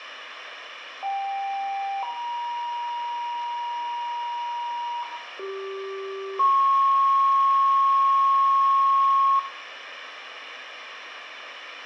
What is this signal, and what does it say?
Two-tone page, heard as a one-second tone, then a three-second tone, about 790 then 950 Hz, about 390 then 1090 Hz, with radio hiss, a squelch burst at the end and room echo.